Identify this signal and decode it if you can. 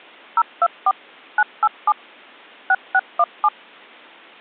DTMF, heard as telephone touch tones, dialled by machine, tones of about 50 ms. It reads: 024 987 6617